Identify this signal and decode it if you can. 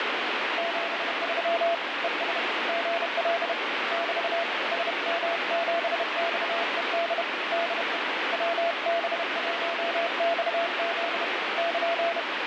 Morse code, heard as a keyed tone, hand-sent with a bug key, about 31 wpm, 680 Hz, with heavy radio static. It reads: 73 ES GL <BT> SM7XED DE WB1XZ <KN>